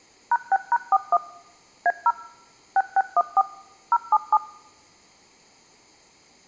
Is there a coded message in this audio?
Yes: DTMF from 0.3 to 4.4 s, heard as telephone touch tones, dialled by machine, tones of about 50 ms. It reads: #6#41 A0 6614 077